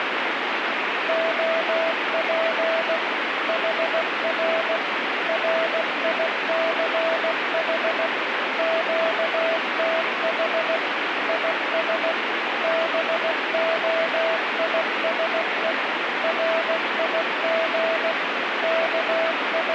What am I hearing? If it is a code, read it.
Morse code, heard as a keyed tone, machine-sent, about 16 wpm, 660 Hz, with heavy radio static. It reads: OP HR RICH QTH IS BOISE RIG …